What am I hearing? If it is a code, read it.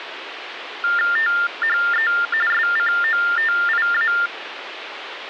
TTY/TDD text telephone tones (45.45 baud Baudot), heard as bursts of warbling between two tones, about 400 Hz shift, 1600 Hz centre, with phone line noise. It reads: THE SCOTIA